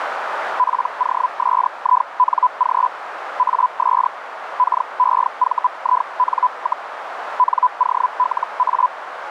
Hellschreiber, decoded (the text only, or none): POSING AS KEVIN, NOLA